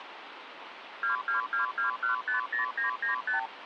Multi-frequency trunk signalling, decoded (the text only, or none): 2222150995